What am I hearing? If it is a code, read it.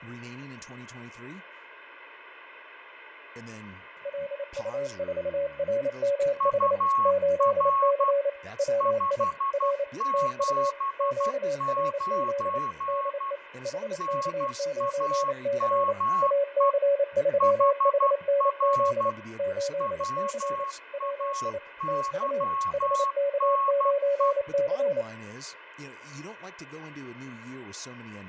Morse code, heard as two keyed tones, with radio static, fading, room echo and speech in English. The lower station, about 28 wpm, 560 Hz: LU4RMH 8C WI R TU QRZ DE HK9C AC3HNZ 8C WI TU HK9C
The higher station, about 12 wpm, 1100 Hz: UR 579 NAME HR WAYNE